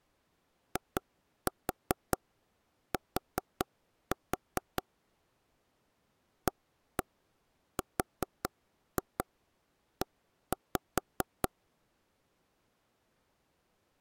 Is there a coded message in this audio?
Yes: tap code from 0.8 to 11.5 s, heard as taps on a table, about 4 knocks a second. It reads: IT ARE